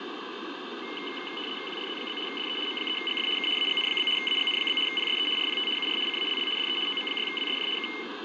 RTTY (75 baud, 850 Hz shift), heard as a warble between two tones, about 2550 Hz centre, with radio static and fading. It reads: QRZ? DE M3GF K AGN? AGN? PSE RPT UR CALL DE OM6WSJ K